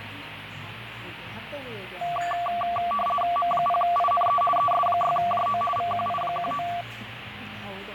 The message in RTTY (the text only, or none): M0INE ES6JO VQI19